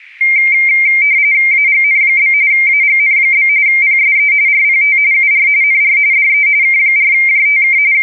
RTTY (45.45 baud, 170 Hz shift), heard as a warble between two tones, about 2200 Hz centre. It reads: AGN? AGN? PSE RPT UR NR DE K4JTK …